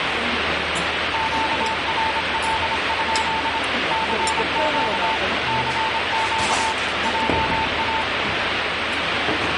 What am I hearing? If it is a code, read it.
Morse code, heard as a keyed tone, machine-sent, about 26 wpm, 890 Hz, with heavy radio static and the noise of a restaurant. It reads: QRL? CQ CQ JA